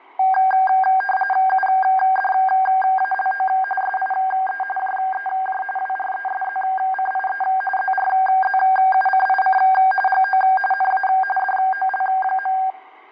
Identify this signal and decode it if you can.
RTTY (45.45 baud, 850 Hz shift), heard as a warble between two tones, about 1180 Hz centre, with radio static and fading. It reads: UDALO SIE JEJ WRESZCIE ZRZUCIC GO NA DOL.